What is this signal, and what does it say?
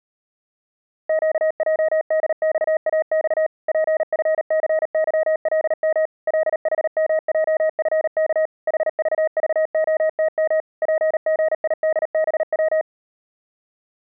Morse code, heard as a keyed tone, machine-sent, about 38 wpm, 630 Hz. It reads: QJDXAX PFCYLM LHMJFK HVVOTM PGIDBW